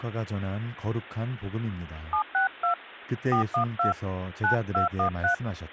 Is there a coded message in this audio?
Yes: DTMF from 2.1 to 5.3 s, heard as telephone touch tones, dialled by hand, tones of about 100 ms, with speech in Korean. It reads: 762 412 9213